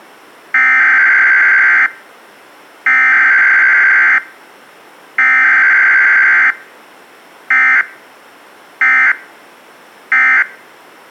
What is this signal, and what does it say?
Emergency Alert System (SAME) tones (header bursts, then end-of-message bursts), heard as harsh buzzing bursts, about 520.83 baud.